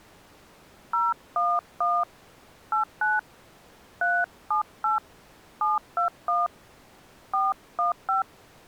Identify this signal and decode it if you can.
DTMF, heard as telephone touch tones, dialled by hand, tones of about 170 ms. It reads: 011 89 378 721 415